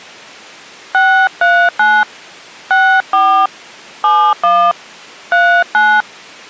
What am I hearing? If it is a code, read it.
DTMF, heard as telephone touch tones, dialled by hand, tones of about 280 ms. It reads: 639 64 71 39